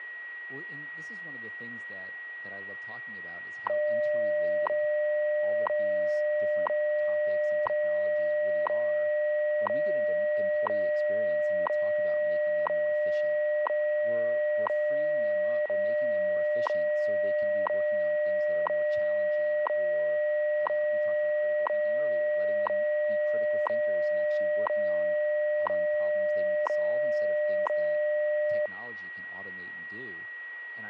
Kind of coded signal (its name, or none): radio time signal